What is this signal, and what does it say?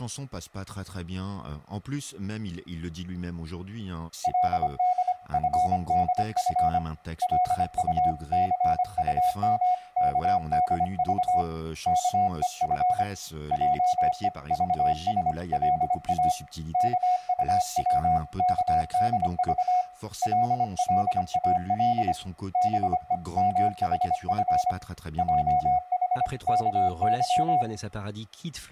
Morse code (Korean alphabet), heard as a keyed tone, hand-sent with a paddle, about 25 wpm, 730 Hz, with speech in French. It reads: 그는 기침을 안 하려고 입을 꼭 다문 후에